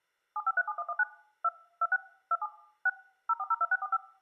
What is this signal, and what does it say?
DTMF, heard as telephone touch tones, dialled by machine, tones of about 40 ms. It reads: 7537119 2 26 27 6 0402645